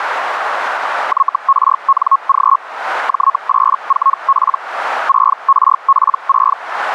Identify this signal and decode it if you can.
Hellschreiber (Feld-Hell, 122.5 baud), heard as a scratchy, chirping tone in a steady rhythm, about 1090 Hz, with radio static. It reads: YRNG J84P 6RP6